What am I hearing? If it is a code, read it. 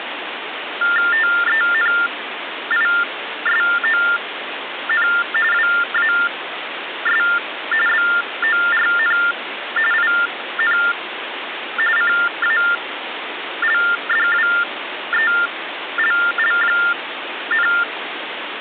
TTY/TDD text telephone tones (45.45 baud Baudot), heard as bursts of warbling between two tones, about 400 Hz shift, 1600 Hz centre, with phone line noise. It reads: TENISON WAS BORN IN CALDWELL,